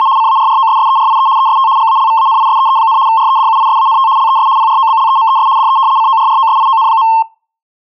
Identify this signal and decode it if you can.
RTTY (75 baud, 170 Hz shift), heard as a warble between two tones, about 980 Hz centre. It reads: … CARROSSERIE EST GALVANISEE, REDUISANT LES PROBLEMES DE CORROSION.